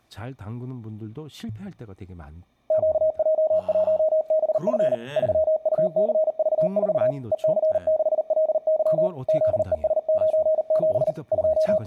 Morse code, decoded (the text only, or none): QJ1BF 3UCV4 EC6LY ZES97 …